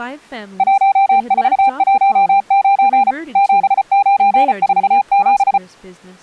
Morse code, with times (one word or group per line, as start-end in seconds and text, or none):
0.6-3.1 1419
3.4-5.6 7947